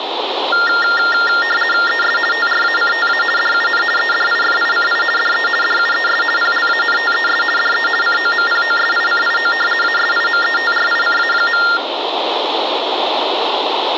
RTTY (50 baud, 450 Hz shift), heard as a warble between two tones, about 1600 Hz centre. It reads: ES TRACTA DUN EDIFICI DE DUES PLANTES DE COMPOSICIO ASIMETRICA.